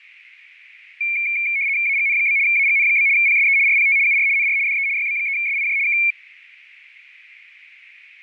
RTTY (75 baud, 170 Hz shift), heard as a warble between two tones, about 2300 Hz centre, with radio static. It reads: AGN? AGN? PSE RPT UR NR DE YB3SIJ K